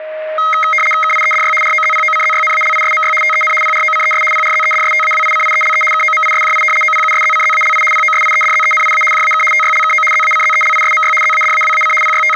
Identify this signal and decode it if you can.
RTTY (75 baud, 850 Hz shift), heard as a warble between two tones, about 1700 Hz centre, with a steady whistle near 620 Hz. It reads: KIEDY ROZPOCZYNALISMY TEN PROCES PRZEDSTAWICIELE KOMISJI OPUSZCZALI POSIEDZENIA JAK TYLKO ZACZELISMY ZADAWAC …